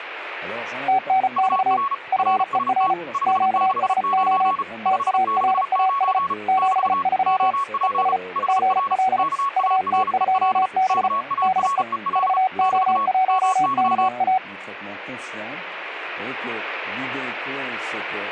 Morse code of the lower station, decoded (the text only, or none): TNX FER QSO TARAS 73 ES GL UT2B DE VO1KA